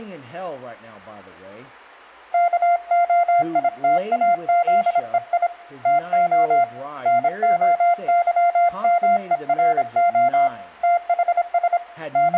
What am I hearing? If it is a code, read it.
Morse code (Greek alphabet), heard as a keyed tone, hand-sent with a paddle, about 26 wpm, 700 Hz, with room echo and speech in English. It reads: ΚΟΙΤΑΖΕΙ ΤΟ ΝΟΥΜΕΡΟ ΤΗΣ …